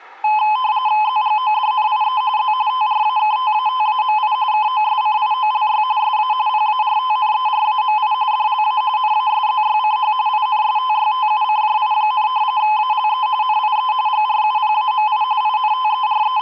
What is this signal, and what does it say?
RTTY (45.45 baud, 170 Hz shift), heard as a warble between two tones, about 940 Hz centre. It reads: ZGODNIE Z TRAKTATAMI KOSCIOLY SA PARTNERAMI DLA NASZYCH INSTYTUCJI, ALE NIE GRUPAMI …